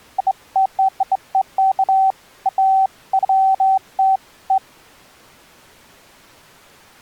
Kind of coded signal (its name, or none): none